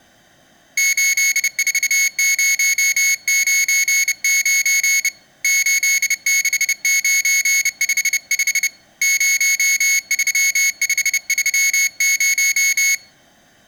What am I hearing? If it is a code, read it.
Morse code, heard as a high beeper, hand-sent with a bug key, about 30 wpm, 2200 Hz. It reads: 84099 86955 03530